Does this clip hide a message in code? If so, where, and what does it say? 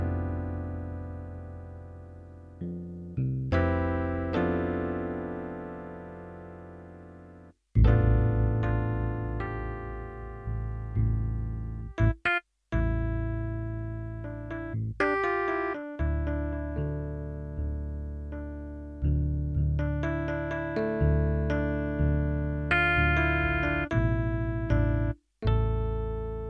No.